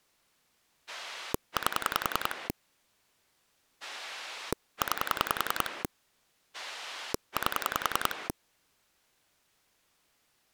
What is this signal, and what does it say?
Pulse dialling, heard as a rotary dial, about 10 pulses a second. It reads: 8 9 8